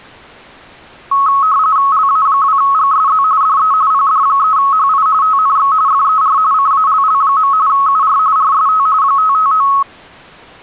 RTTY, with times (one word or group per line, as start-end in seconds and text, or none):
1.9-3.2 LA2GSZ
3.4-3.7 DE
3.9-5.1 PD3HI
5.2-5.7 TNX
5.9-6.4 FER
6.5-7.5 CALL.
7.7-8.2 UR
8.4-8.9 RST
9.0-9.7 559